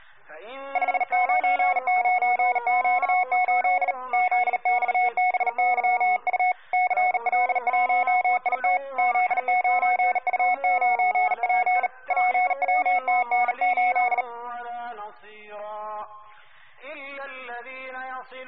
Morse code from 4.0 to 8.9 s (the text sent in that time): ZXBYU CL1IT